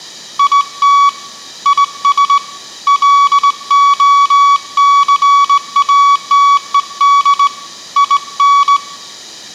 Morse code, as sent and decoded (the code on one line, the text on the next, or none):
.. - / .. ... / .-.. --- -.-. .- - . -.. / .. -.
IT IS LOCATED IN